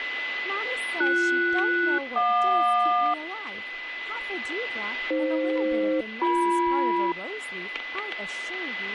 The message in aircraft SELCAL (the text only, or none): BS-JQ AF-BM